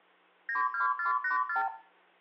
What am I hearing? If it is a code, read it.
Multi-frequency trunk signalling (R2, with the far end's replies), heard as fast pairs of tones, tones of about 130 ms, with hum and room echo. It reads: 92484